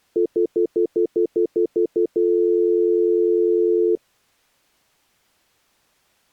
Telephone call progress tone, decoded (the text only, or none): stutter dial tone